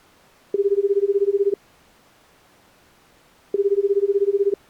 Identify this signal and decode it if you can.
Telephone call progress tone (Japanese plan), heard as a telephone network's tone, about 380, 400, 420 Hz, 1 s on and 2 s off. Ringback tone.